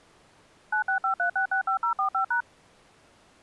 DTMF, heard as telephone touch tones, dialled by machine, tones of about 100 ms. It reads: 9653665045#